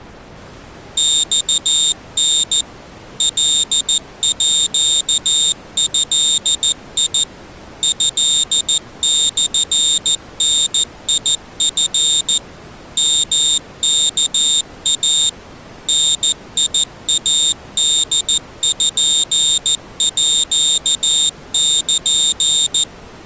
Morse code (Japanese Wabun code), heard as a high beeper, machine-sent, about 14 wpm, 3650 Hz. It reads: マタ カード トモダチ ヨワイ ダイポール